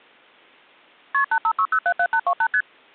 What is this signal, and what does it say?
Multi-frequency trunk signalling (R1, as on North American trunks), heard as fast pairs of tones, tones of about 70 ms. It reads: KP 856077828 ST